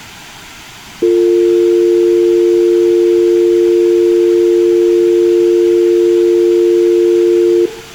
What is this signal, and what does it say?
Telephone call progress tone (North American or UK plan), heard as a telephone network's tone, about 350, 450 Hz, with room echo. Dial tone.